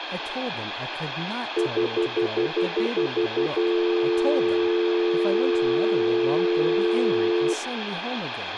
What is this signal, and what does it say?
Telephone call progress tone (North American plan), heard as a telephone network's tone, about 350, 440 Hz, 0.1 s on and 0.1 s off, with phone line noise, room echo and speech in English. Stutter dial tone.